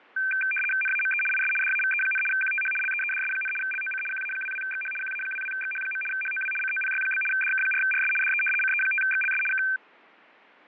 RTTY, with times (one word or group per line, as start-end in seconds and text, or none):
0.8-1.2 NAME
1.3-1.5 IS
1.6-2.2 DAVE,
2.3-2.7 QTH
2.8-3.5 LEEDS,
3.6-4.0 LOC
4.1-4.9 QA22XH
5.0-6.0 QA22XH.
6.1-6.5 HOW
6.6-7.2 COPY?
7.3-8.1 DK4RS
8.2-8.4 DE
8.6-9.4 CE5XLS
9.5-9.6 K